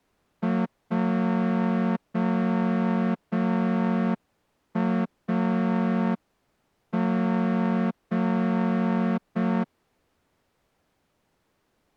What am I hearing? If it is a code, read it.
Morse code, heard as a horn, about 5 wpm. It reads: JAG